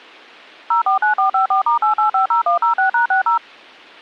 DTMF, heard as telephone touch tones, dialled by machine, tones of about 120 ms, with a squelch burst at the end. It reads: 049454*8850106#60